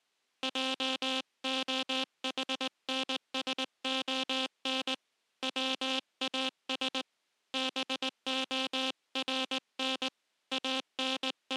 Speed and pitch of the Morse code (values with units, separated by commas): 19 wpm